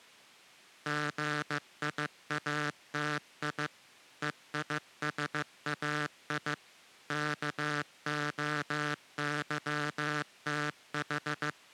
Morse code (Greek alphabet), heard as a buzzer, machine-sent, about 15 wpm. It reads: ΓΙΑΤΙ ΕΙΣΑΙ ΚΟΥΤΗ